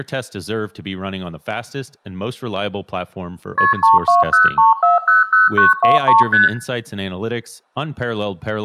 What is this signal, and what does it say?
Multi-frequency trunk signalling (R1, as on North American trunks), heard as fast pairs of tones, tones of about 160 ms, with room echo and speech in English. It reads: KP 3203400923 ST